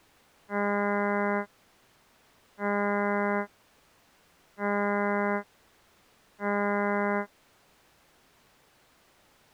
Ship horn signal, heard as a ship's horn, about 200 Hz. 4 short. At sea: a pilot vessel's identity signal in fog.